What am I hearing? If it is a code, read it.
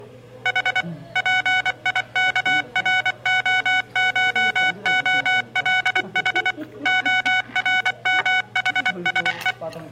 Morse code (Greek alphabet), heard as electronic beeps, machine-sent, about 24 wpm, 740 Hz, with room echo and the noise of a restaurant. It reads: Η ΠΙΚΡΟΧΟΛΗ ΟΡΜΗΣΕ